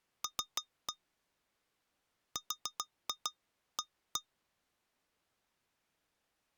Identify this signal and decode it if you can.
Tap code, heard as taps on glass, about 6 knocks a second. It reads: L RA